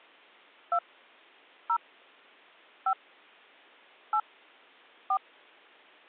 DTMF, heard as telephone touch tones, dialled by hand, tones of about 70 ms. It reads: 2 0 5 8 4